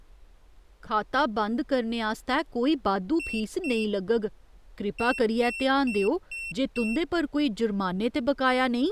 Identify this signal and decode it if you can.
Beep code, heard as a piezo beeper, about 2700 Hz, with speech in Dogri. 2-5.